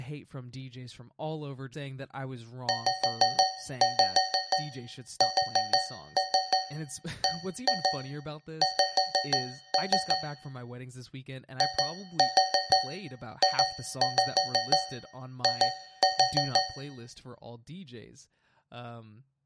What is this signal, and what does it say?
Tap code, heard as taps on a metal pipe, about 6 knocks a second, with speech in English. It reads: ZSBX IJI